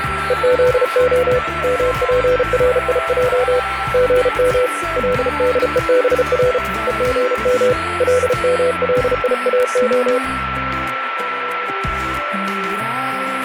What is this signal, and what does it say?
Morse code (Hebrew alphabet), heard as a keyed tone, hand-sent with a paddle, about 34 wpm, 500 Hz, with radio static and a steady whistle near 1340 Hz. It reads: וזה מפריע גם לדובר וגם למליאה